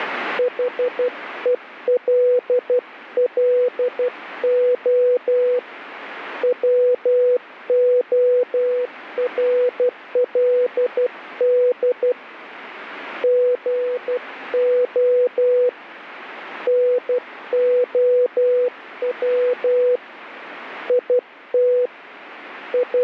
Morse code, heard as a keyed tone, hand-sent with a paddle, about 12 wpm, 500 Hz, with radio static. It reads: HELLO WORLD GO NOW IT …